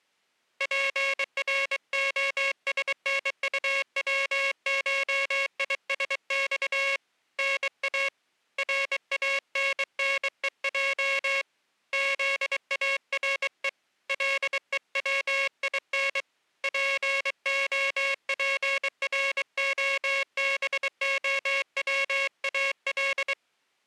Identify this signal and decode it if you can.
Morse code (Russian alphabet), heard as a buzzer, hand-sent with a bug key, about 23 wpm. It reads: ПРОСНУВШИСЬ НА РАННЕЙ ЗАРЕ ЛЕВИН ПОПРОБОВАЛ